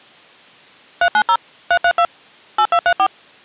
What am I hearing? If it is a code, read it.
DTMF, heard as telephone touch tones, dialled by machine, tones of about 70 ms. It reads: 390 332 8234